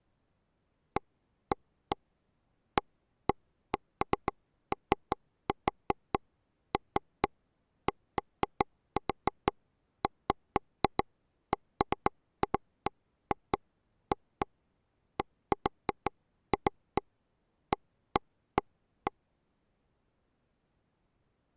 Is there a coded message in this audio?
No, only irregular taps on a table.